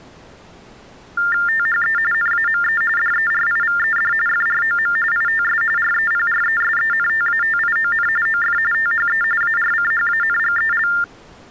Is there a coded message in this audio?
Yes: TTY/TDD text telephone tones (45.45 baud Baudot) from 1.2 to 11.0 s, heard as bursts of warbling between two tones, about 400 Hz shift, 1600 Hz centre. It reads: THE NAME DERIVED FROM ITS REPRESENTATION OF THE ARCHANGEL